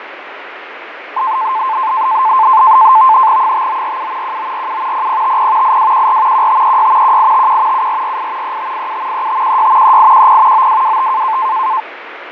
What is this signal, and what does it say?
NAVTEX (SITOR-B), 100 baud, 170 Hz shift, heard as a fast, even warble, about 960 Hz centre, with radio static and fading. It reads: 5947 1947 0050 8214 1536 1851 7448 3587 3516 3810 9225